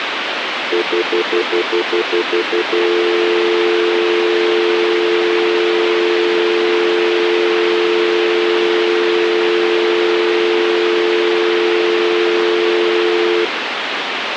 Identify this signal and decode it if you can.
Telephone call progress tone (North American plan), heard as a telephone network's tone, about 350, 440 Hz, 0.1 s on and 0.1 s off, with phone line noise. Stutter dial tone.